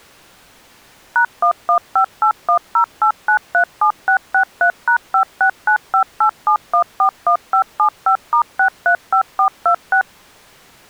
DTMF, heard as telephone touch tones, dialled by machine, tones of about 90 ms. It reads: #1158108937663#569587141575*635426